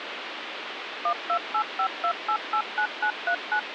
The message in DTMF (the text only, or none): 12852889939